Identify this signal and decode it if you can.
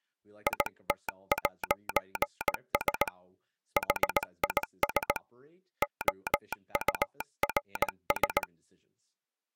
Morse code, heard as a telegraph sounder, hand-sent with a paddle, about 18 wpm, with speech in English. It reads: IT'S HIS OURS